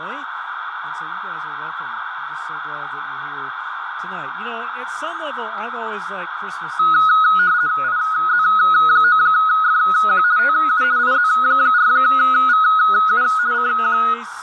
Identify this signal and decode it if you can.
RTTY (50 baud, 170 Hz shift), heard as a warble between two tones, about 1360 Hz centre, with radio static and a narrow filter. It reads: IZ9FQ TU IZ4VU CQ